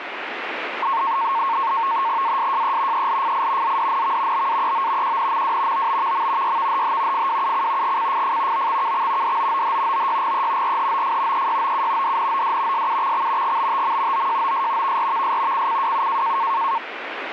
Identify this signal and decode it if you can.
NAVTEX (SITOR-B), 100 baud, 170 Hz shift, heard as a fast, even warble, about 1000 Hz centre, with radio static. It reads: ASJE ELFI ZDNV BAEO QNMW OBVM YVHH FWUC GCFF OXKX DOOH OYGE RHOF EYOU DNOD SUXX GBTM OJOS VRVS CCWU